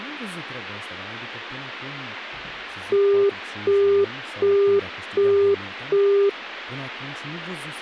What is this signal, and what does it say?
Telephone call progress tone (as in the UK, Australia and similar networks), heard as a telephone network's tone, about 400 Hz, 0.375 s on and 0.375 s off, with speech in Romanian. Busy tone.